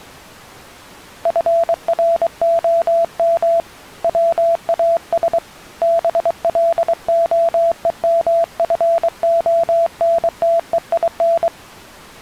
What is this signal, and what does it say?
Morse code, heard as a keyed tone, hand-sent with a paddle, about 23 wpm, 670 Hz. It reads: FROM WAS BLOEMFONTEIN